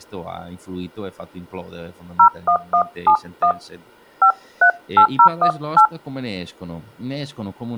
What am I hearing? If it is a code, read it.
DTMF, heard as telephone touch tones, dialled by hand, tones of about 90 ms, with speech in Italian. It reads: 01171 538018